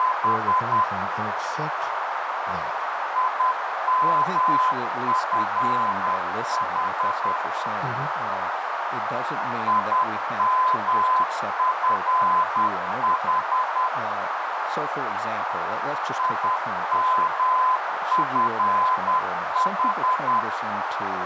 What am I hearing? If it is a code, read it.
Morse code, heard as a keyed tone, machine-sent, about 10 wpm, 1020 Hz, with heavy radio static, a narrow filter and speech in English. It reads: … IMFH IMFH IMFH